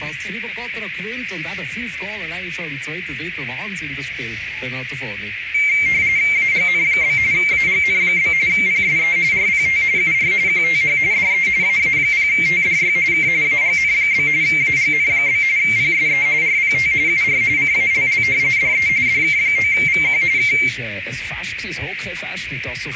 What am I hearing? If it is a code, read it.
RTTY (45.45 baud, 170 Hz shift), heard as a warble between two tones, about 2200 Hz centre, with radio static and a narrow filter. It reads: AGN? AGN? PSE RPT UR QTH DE AA0TDY K AGN? AGN? PSE RPT UR CALL DE DK9VQ K